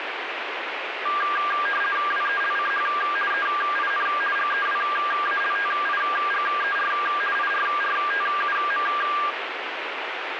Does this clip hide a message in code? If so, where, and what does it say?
Yes: RTTY (50 baud, 450 Hz shift) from 1.1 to 9.3 s, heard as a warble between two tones, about 1400 Hz centre, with radio static. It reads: WELCH EIN GEWALTIGER IRRTUM